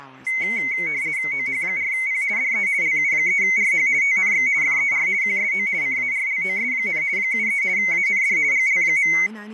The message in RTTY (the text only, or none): OH4P DE LU3RH TNX FER QSO CARLOS, 73 AND GL.